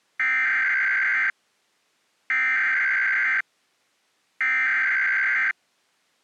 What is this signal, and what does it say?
Emergency Alert System (SAME) tones (header bursts), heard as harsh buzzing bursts, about 520.83 baud.